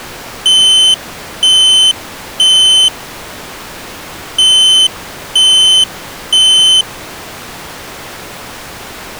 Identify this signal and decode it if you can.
Alarm pattern, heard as an alarm's beeps, played twice, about 3050 Hz. Temporal three. Smoke or fire, evacuate.